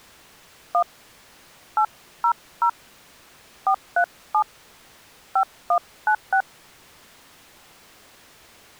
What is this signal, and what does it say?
DTMF, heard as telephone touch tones, dialled by hand, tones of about 80 ms. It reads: 1 800 437 5196